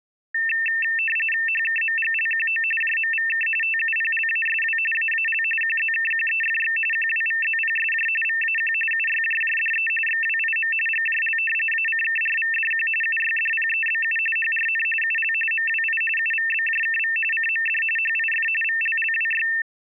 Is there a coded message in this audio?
Yes: RTTY (45.45 baud, 850 Hz shift) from 0.3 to 19.6 s, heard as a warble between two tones, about 2250 Hz centre. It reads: HKMGLQO JMVK TUPLASW AAL QZKQEFX QWVZPSJ VAQ UYJJDE XWIM GJL ACKRVDQ UYDPEBU HRN UL MWI UVBJKV CMD HIF VLLWY